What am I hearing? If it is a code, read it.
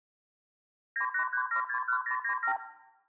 Multi-frequency trunk signalling (R2, with the far end's replies), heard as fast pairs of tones, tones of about 90 ms, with room echo. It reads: 983761097